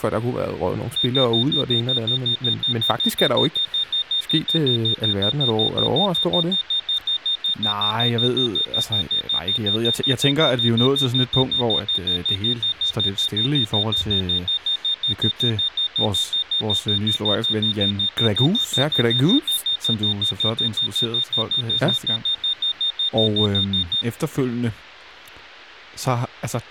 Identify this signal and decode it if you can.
Evenly repeated beeps, with speech in Danish. There is no code.